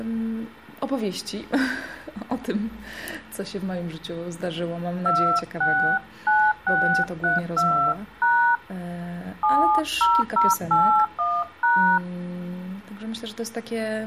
DTMF, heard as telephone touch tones, dialled by hand, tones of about 260 ms. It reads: 269632# 70081#